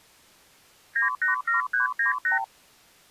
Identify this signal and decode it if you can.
Multi-frequency trunk signalling (R2, with the far end's replies), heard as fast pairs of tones, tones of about 130 ms. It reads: 987398